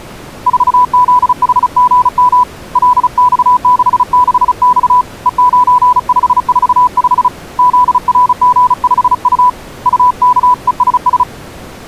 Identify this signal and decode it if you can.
Morse code, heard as a keyed tone, hand-sent with a paddle, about 35 wpm, 990 Hz. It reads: 4ZHGM LX66X E9545 ZRG5U UKESS